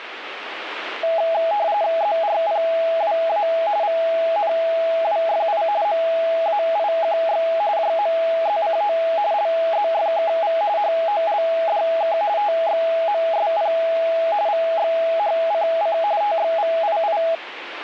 RTTY (45.45 baud, 170 Hz shift), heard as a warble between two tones, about 740 Hz centre, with radio static. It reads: ZRPWA VNWFI MAIQX JMZCO LZFKV HOLDK TXMSP VXHCC TXVII